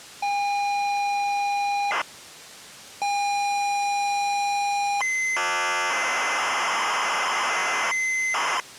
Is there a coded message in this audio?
Yes: ZX Spectrum tape loading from 0.2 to 8.6 s, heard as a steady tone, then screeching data.